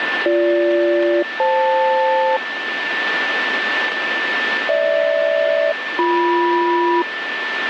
Aircraft SELCAL, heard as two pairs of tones, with radio static and a steady whistle near 1770 Hz. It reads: BG-FL GH-BM